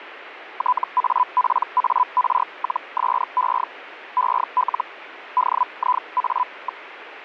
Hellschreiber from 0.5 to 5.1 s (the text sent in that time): TAPAR-SE EL